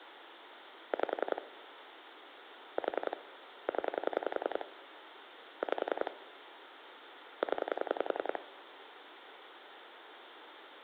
Pulse dialling, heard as clicks on a phone line, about 10 pulses a second, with phone line noise. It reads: 5 4 0 5 0